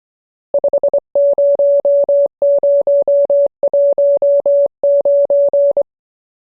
Morse code, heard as a keyed tone, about 24 wpm, 570 Hz. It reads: 50019